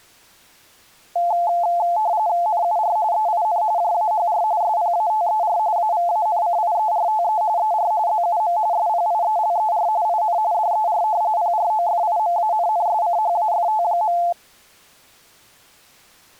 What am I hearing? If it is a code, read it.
RTTY (45.45 baud, 170 Hz shift), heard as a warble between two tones, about 780 Hz centre. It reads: NUR EIN JAHR SPATER AVANCIERTE ER ZUM SPIELER IN DER PROFIMANNSCHAFT.